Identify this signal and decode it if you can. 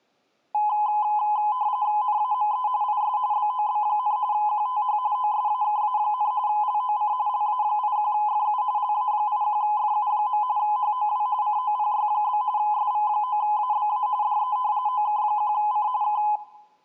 RTTY (45.45 baud, 170 Hz shift), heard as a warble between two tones, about 930 Hz centre, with room echo. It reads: NAME IS BOB, QTH OSAKA, LOC LA81FU LA81FU. HOW COPY? SV9ABA DE OK1C K